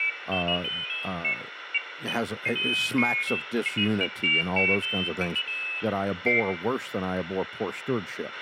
Pairs of high tones at irregular times, with radio hiss, a squelch burst at the end, room echo and speech in English. There is no code.